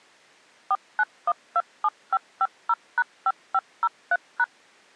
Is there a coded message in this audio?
Yes: DTMF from 0.7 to 4.4 s, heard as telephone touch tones, dialled by machine, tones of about 50 ms. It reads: 49127550#5503#